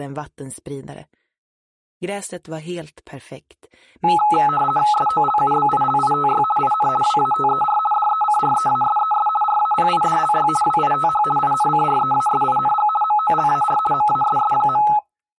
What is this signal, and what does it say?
RTTY (50 baud, 450 Hz shift), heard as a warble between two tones, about 1070 Hz centre. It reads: SOLUBILITY IN WATER DECREASES RAPIDLY WITH INCREASING MOLAR MASS.